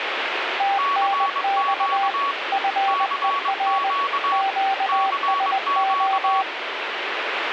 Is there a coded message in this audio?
Yes: Morse code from 0.5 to 6.5 s, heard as two keyed tones, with radio static. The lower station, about 20 wpm, 780 Hz: TNX FER QSO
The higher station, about 22 wpm, 1120 Hz: CQ CQ CQ